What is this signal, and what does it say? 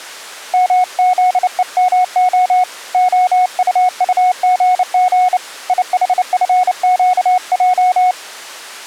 Morse code, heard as a keyed tone, hand-sent with a bug key, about 29 wpm, 730 Hz. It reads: MZEMO OUUGG IHFQJ